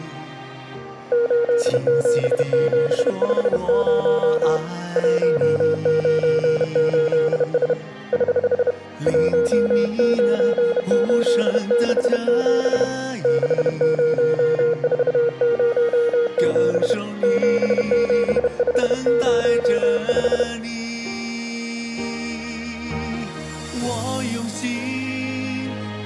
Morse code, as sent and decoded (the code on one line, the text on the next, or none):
---.. --... --... ..... ----- / .---- ----. ---.. ... / ........ / .---- ----. ---.. -.... --... / -.... ----- ....- ----- --... / --... --... ..... ----- .....
87750 198S <HH> 19867 60407 77505